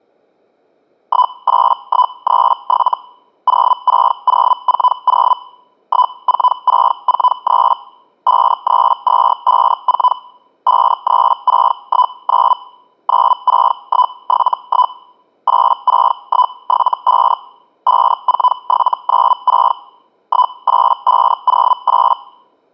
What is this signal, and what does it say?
Hellschreiber (Feld-Hell, 122.5 baud), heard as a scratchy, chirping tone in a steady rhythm, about 1000 Hz. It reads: 18137 06040 14643 53254 53619 96171 86175 54796 18508